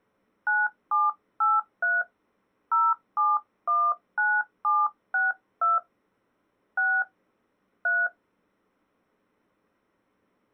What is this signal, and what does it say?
DTMF, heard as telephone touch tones, dialled by hand, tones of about 200 ms. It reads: 9783 0719762 6 3